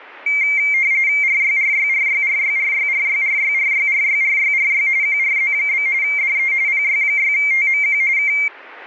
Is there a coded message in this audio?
Yes: RTTY (45.45 baud, 170 Hz shift) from 0.3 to 8.5 s, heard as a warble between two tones, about 2200 Hz centre. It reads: RYRYRYRYRYRYRYRYRYRYRY QRZ? DE PY6TMQ K